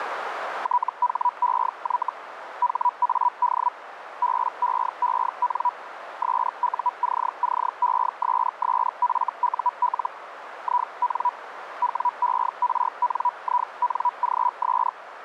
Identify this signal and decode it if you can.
Hellschreiber (Feld-Hell, 122.5 baud), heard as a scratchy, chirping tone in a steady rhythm, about 980 Hz, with radio static and a narrow filter. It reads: THEY HAD BEEN SUCCESSFUL IN WERNINGS